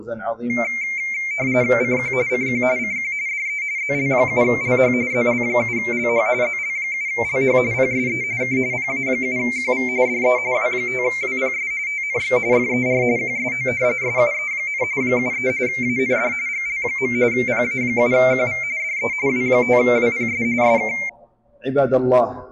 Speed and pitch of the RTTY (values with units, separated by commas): 45.45 baud, 170 Hz shift, 2200 Hz centre